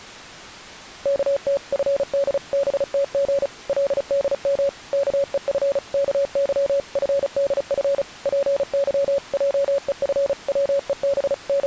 Morse code (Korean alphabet), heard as a keyed tone, machine-sent, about 35 wpm, 560 Hz. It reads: 어느덧 금 안에는 …